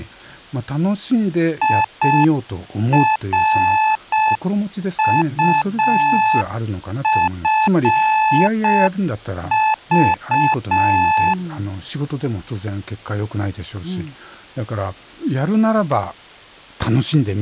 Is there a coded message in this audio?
Yes: Morse code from 1.6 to 11.4 s, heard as a keyed tone, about 6 wpm, 870 Hz. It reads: IRUFV